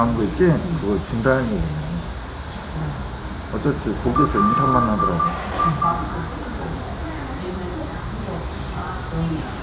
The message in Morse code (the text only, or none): LI